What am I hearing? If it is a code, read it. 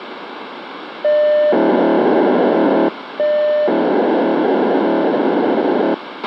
POCSAG pager data (1200 baud), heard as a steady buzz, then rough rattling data, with radio hiss and a squelch burst at the end.